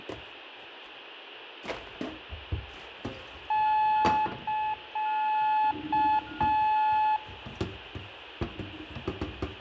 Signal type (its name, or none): Morse code